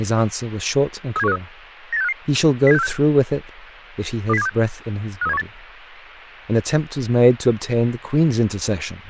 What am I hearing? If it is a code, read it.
Five-tone selective call (EEA), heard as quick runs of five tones, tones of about 40 ms, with radio hiss and speech in English. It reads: 37153 98655 07646 20726 53718